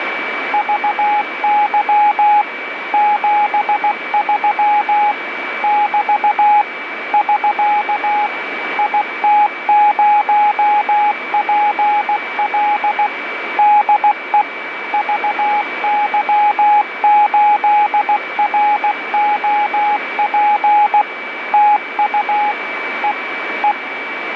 Morse code, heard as a keyed tone, machine-sent, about 16 wpm, 840 Hz, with radio static and a steady whistle near 2300 Hz. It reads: VY 73 <BT> <SK> IT0PL DE VY8ROP TU E E